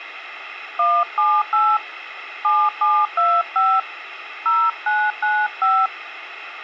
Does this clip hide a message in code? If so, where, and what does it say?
Yes: DTMF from 0.8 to 5.9 s, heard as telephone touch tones, dialled by hand, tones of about 240 ms, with radio hiss. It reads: 178 7725 0995